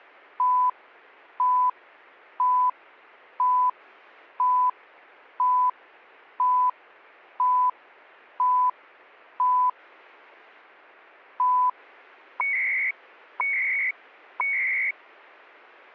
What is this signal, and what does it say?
Radio time signal (CHU, Canada), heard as beeps and data bursts, one a second.